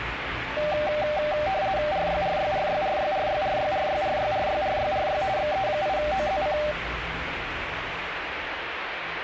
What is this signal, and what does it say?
RTTY (50 baud, 170 Hz shift), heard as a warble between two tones, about 690 Hz centre, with radio static and the noise inside a lift. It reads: RYRYRYRYRYRYRYRYRYRYRY XE8OZC